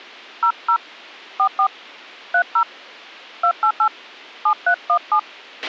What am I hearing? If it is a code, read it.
DTMF, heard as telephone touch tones, dialled by hand, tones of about 80 ms, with a squelch burst at the end. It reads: 00 44 30 288 7317